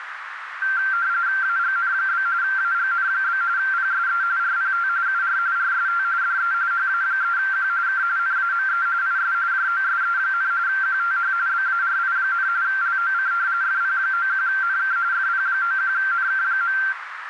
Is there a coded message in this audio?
Yes: RTTY (45.45 baud, 170 Hz shift) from 0.6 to 16.9 s, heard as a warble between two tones, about 1470 Hz centre, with radio static and a narrow filter. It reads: AGN? AGN? PSE RPT UR RST DE HA3Q K NAME IS JOSE, QTH BARI, LOC FP91NK FP91NK.